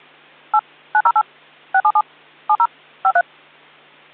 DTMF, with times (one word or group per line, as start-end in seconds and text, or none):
0.5-0.6 8
0.9-1.2 908
1.7-2.0 677
2.5-2.7 70
3.0-3.2 53